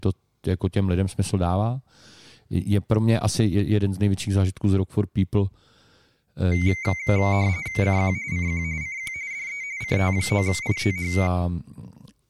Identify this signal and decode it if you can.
RTTY (45.45 baud, 170 Hz shift), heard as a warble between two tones, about 2150 Hz centre, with speech in Czech. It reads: CQ CQ CQ DE CT9ITH